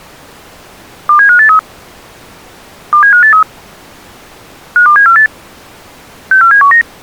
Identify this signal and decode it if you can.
Five-tone selective call (CCIR), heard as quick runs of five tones, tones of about 100 ms. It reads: 27583 27583 52748 64719